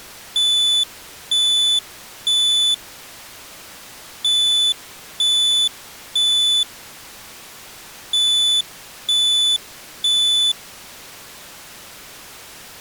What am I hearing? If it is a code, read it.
Alarm pattern, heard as an alarm's beeps, played three times, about 3500 Hz. Temporal three. Smoke or fire, evacuate.